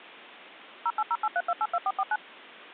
DTMF, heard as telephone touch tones, dialled by machine, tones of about 50 ms. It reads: 08083282449